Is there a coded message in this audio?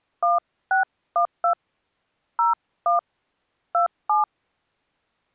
Yes: DTMF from 0.2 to 4.2 s, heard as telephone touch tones, dialled by hand, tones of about 130 ms. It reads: 1612 01 27